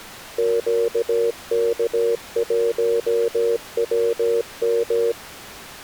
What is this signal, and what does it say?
Morse code, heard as a keyed tone, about 17 wpm, 460 Hz. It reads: QK1WM